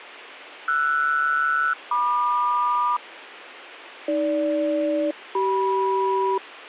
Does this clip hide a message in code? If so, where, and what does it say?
Yes: aircraft SELCAL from 0.7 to 6.4 s, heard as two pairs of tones, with radio hiss. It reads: RS-MQ AG-CM